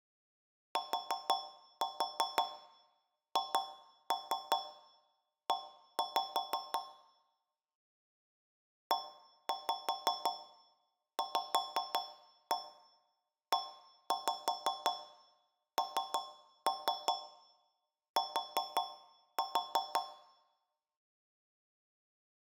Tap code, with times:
0.8-6.8 THE
8.9-20.0 EVENT

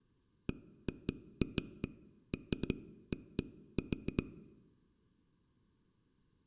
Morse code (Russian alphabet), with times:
none

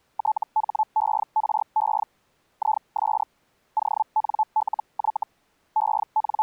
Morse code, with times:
none

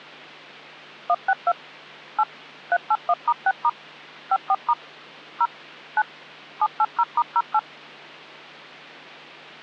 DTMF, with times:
1.1-1.5 162
2.2-2.2 8
2.7-3.7 381*6*
4.3-4.7 54*
5.4-5.5 0
6.0-6.0 9
6.6-7.6 780*08

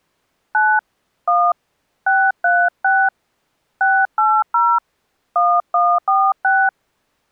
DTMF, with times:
0.5-0.8 9
1.3-1.5 1
2.1-3.1 636
3.8-4.8 680
5.4-6.7 1146

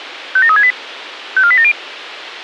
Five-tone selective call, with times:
0.4-0.7 57368
1.4-1.7 54870

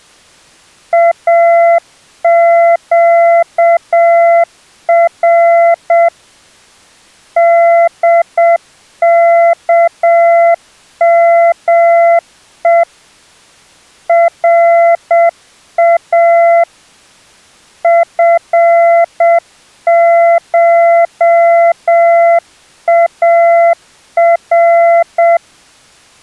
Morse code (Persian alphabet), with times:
0.9-6.1 اگر
7.4-12.8 دکمه
14.1-16.6 را
17.8-25.4 فشار

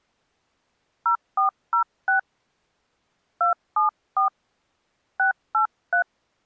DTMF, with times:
1.1-2.2 0406
3.4-4.3 274
5.2-6.0 683

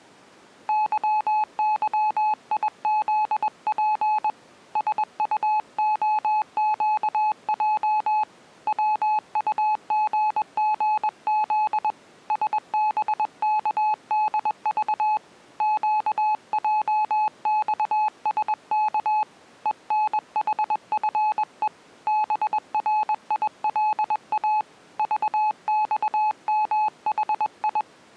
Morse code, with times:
0.7-4.3 YYIZP
4.8-8.2 SUOQJ
8.7-11.9 WUGGZ
12.3-15.2 SBKDV
15.6-19.2 QJXSK
19.7-21.7 ENHFE
22.1-24.6 BRILA
25.0-27.8 VXMHI

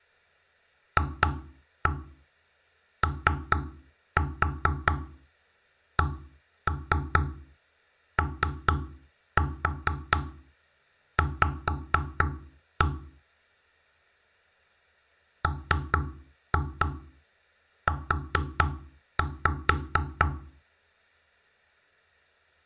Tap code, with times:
1.0-12.9 FOCOV
15.4-20.3 MU

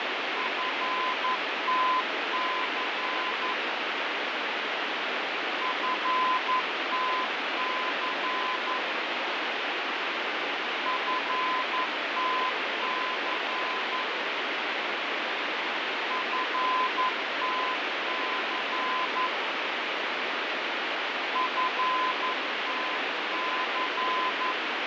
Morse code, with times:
0.4-3.5 FTC
5.6-8.8 FTC
10.9-14.0 FTC
16.1-19.3 FTC
21.4-24.5 FTC

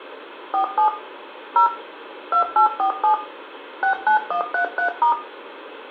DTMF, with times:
0.5-0.9 47
1.6-1.7 0
2.3-3.1 2847
3.8-5.1 69133*

